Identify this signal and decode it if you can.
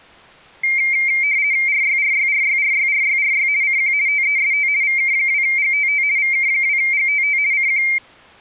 RTTY (50 baud, 170 Hz shift), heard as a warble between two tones, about 2200 Hz centre. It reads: RYRYRYRYRYRY CQ TEST VK2GTT VK2GTT CQ